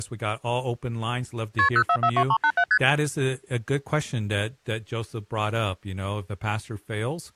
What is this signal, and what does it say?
Multi-frequency trunk signalling (R1, as on North American trunks), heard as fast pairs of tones, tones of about 70 ms, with speech in English. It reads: KP 0442387 ST